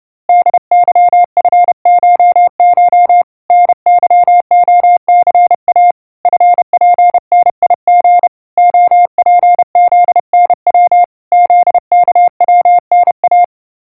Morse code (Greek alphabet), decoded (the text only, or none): ΔΥΦΧΧ ΝΥΟΘΑ ΦΠΝΙΓ ΟΠΖΝΩ ΖΚΩΝΑ